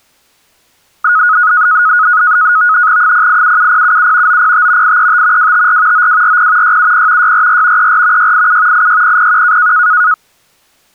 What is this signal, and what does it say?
NAVTEX (SITOR-B), 100 baud, 170 Hz shift, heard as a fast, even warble, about 1360 Hz centre. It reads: 0877077 905 835 254 9240 670 644 34 687 86001